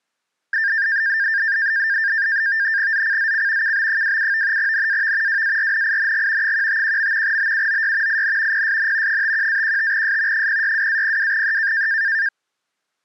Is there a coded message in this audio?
Yes: NAVTEX (SITOR-B), 100 baud, 170 Hz shift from 0.5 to 12.3 s, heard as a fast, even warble, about 1700 Hz centre. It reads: ZCZC KB27 NAV WARNING 151. BUOY IN PSN 51-15S 062-02E